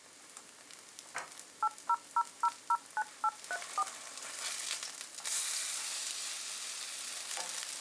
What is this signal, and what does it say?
DTMF, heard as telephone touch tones, dialled by machine, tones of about 50 ms, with kitchen noise. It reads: 800009834